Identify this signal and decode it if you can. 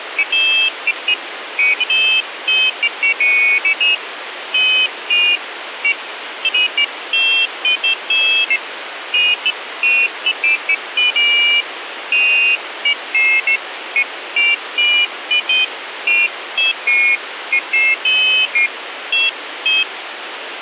Pairs of high tones at irregular times, with phone line noise. There is no code.